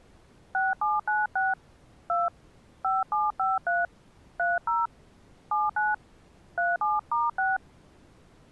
DTMF, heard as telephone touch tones, dialled by hand, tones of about 180 ms. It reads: 6796 2 5753 30 79 37*6